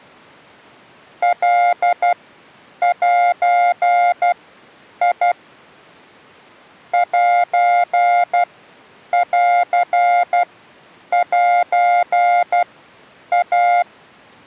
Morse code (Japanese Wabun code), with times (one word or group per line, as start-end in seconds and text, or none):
1.2-5.3 カゼ
6.9-13.8 センセイ